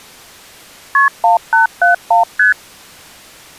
Multi-frequency trunk signalling (R1, as on North American trunks), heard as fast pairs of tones, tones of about 130 ms. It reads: KP 1871 ST